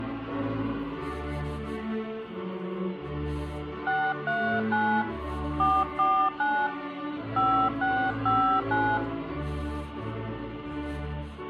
DTMF, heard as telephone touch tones, dialled by hand, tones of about 290 ms, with hum and room echo. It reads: 639 449 5659